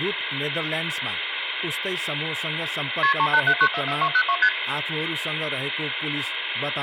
Multi-frequency trunk signalling (R1, as on North American trunks), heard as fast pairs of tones, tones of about 70 ms, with phone line noise and speech in Nepali. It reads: KP 387944202 ST